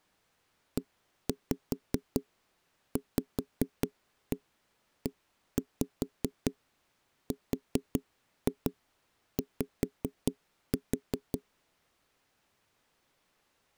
Tap code, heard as knocks on wood, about 5 knocks a second. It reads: EVERY